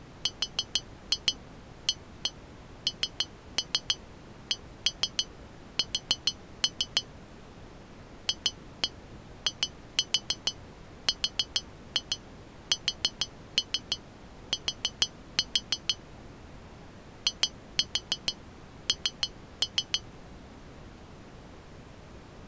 Tap code, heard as taps on glass, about 6 knocks a second. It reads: RANKS FIRST IN